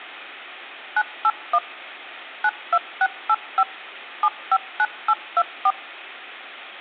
DTMF, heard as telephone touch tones, dialled by machine, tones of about 50 ms. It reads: 981 92685 759824